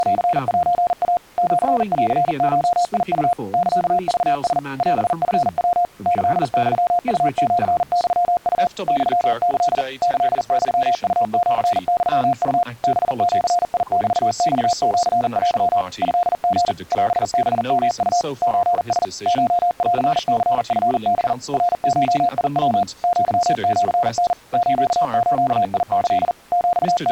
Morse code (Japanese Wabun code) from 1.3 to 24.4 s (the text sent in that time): シンゴウ サクラ オチヤ キユウシユウ ユキ キユウシユウ ハジメマシテ トリ オハヨウ ソラ コンニチハ ナゴヤ アシタ